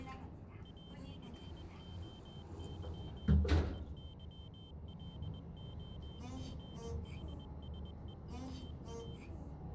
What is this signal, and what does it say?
Morse code (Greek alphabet), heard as a high beeper, machine-sent, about 21 wpm, 3100 Hz, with the noise inside a lift. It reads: ΑΦΟΥ ΕΥΛΟΓΗΣΕ ΤΑ